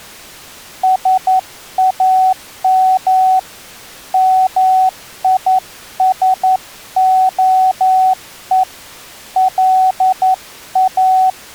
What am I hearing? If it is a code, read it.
Morse code (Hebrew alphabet), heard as a keyed tone, hand-sent with a paddle, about 11 wpm, 750 Hz. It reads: שאם מישהו לא